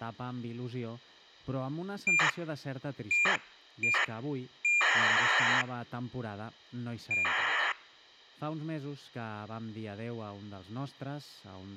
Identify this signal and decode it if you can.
ACARS aircraft data, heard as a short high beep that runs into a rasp, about 2400 baud.